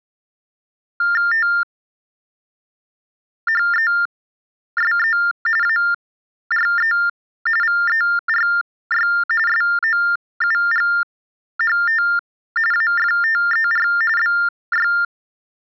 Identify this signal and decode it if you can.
TTY/TDD text telephone tones (45.45 baud Baudot), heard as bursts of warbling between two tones, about 400 Hz shift, 1600 Hz centre. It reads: THESE ARE VERY SOUGHT AFTER BY